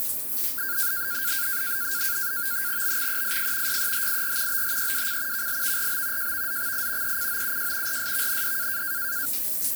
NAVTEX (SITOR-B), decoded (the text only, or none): BXEIF YEHIR BHEWC KLVRB JVZXI ECOUJ RSVND